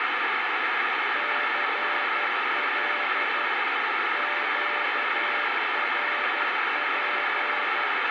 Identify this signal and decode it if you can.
Morse code, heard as a keyed tone, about 12 wpm, 590 Hz, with heavy radio static. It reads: CL QRP